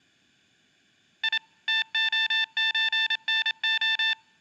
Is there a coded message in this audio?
Yes: Morse code (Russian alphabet) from 1.2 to 4.2 s, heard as electronic beeps, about 27 wpm, 890 Hz, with room echo. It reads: И ТОЧНО